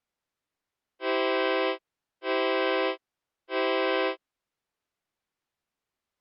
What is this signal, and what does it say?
Train horn signal, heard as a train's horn. 3 short. On North American railways: when stopped, the train will back up.